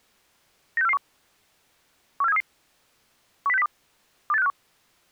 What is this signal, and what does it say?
Five-tone selective call (EEA), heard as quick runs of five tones, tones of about 40 ms. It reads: 96441 14733 10602 28651